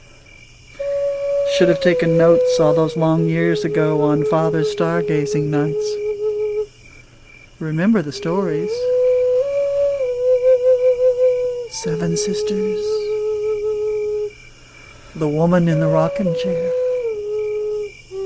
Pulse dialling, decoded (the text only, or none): none